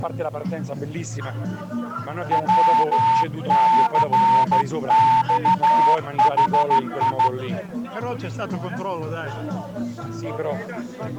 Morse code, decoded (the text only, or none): WCXHI